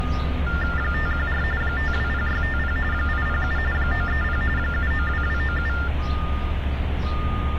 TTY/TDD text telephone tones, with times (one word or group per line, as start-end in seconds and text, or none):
0.8-1.4 514
1.6-2.8 520650
2.9-3.6 807
3.7-4.4 930
4.6-5.7 792297